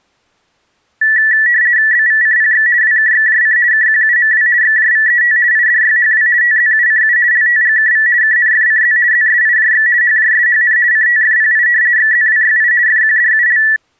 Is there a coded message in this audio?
Yes: RTTY (50 baud, 170 Hz shift) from 1.0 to 13.8 s, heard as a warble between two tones, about 1850 Hz centre. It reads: BVCPX WKXJC KQUMW XJVET IDYHW TZUCU LTGKV KNFCZ ZSIJX HJSHN CTFPI XZWYI FQDUL